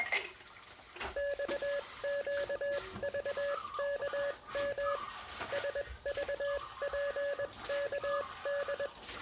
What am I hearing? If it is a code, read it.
Morse code, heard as a keyed tone, machine-sent, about 21 wpm, spaced as for 18 wpm, 570 Hz, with kitchen noise. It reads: XQVKM SVPKD